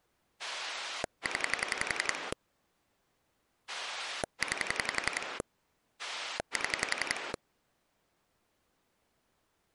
Pulse dialling, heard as a rotary dial, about 11 pulses a second. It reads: 0 9 7